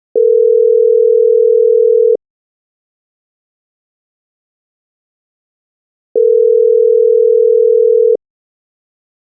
Telephone call progress tone (North American plan), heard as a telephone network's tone, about 440, 480 Hz, 2 s on and 4 s off. Ringback tone.